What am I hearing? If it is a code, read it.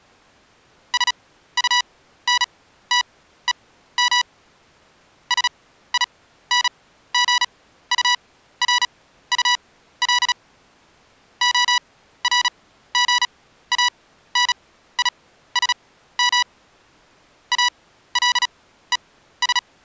Morse code, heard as electronic beeps, machine-sent, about 36 wpm, spaced as for 15 wpm, 980 Hz. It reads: SUNTEM SINGURUL ORGANISM ALES